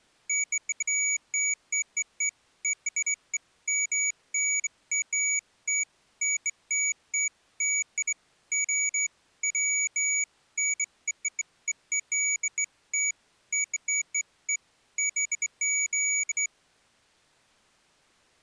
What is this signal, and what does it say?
Beeps of irregular length. There is no code.